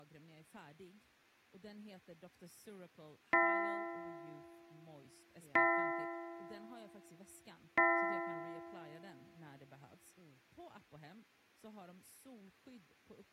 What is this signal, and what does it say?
Clock strike, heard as a bell, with room echo and speech in Swedish. 3. Three o'clock.